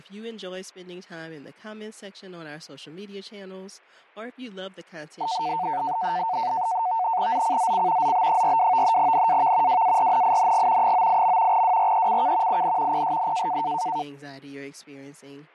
NAVTEX (SITOR-B), 100 baud, 170 Hz shift, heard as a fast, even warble, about 820 Hz centre, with fading and speech in English. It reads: ZCZC ZB42 NAV WARNING 98. WRECK IN PSN